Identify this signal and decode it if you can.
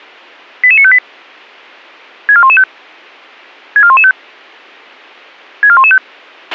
Five-tone selective call (ZVEI), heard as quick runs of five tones, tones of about 70 ms, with a squelch burst at the end. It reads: 88958 64115 64115 64115